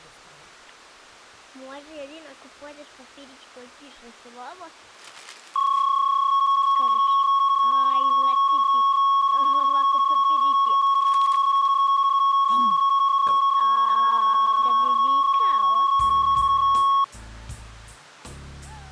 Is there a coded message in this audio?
Yes: PSK31 (31.25 baud) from 5.6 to 17.0 s, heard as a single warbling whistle, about 1100 Hz.